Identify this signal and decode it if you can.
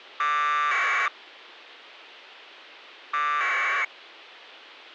Packet radio (AX.25, as in APRS), 1200 baud, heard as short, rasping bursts.